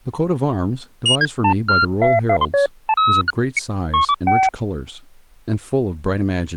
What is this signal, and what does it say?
Electronic bleeps of random pitch and length, with speech in English. There is no code.